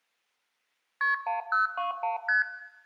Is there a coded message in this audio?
Yes: multi-frequency trunk signalling (R1, as on North American trunks) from 1.0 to 2.4 s, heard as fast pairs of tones, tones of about 140 ms, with room echo. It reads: KP 1021 ST